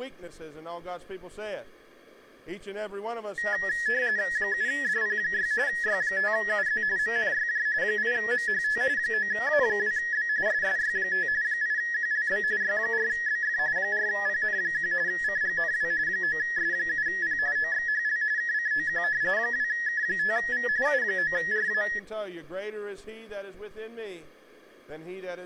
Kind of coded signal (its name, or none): RTTY